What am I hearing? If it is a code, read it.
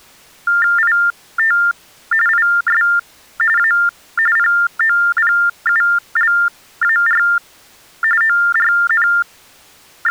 TTY/TDD text telephone tones (45.45 baud Baudot), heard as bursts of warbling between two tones, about 400 Hz shift, 1600 Hz centre. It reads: IT IS A POPULAR …